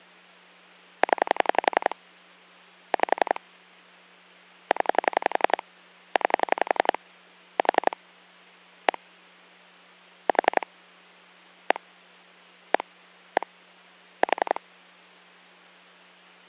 Pulse dialling, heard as clicks on a phone line, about 11 pulses a second, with hum. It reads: 0 5 0 9 4 1 4 1 1 1 4